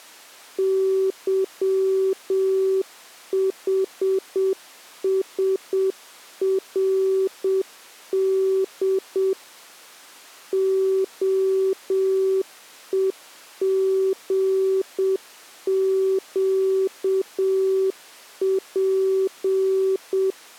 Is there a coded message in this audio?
Yes: Morse code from 0.5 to 20.4 s, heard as a keyed tone, machine-sent, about 7 wpm, 380 Hz. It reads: YHSRD OEGQP